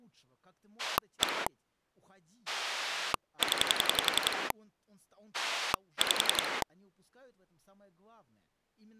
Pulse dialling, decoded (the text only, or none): 1 0 5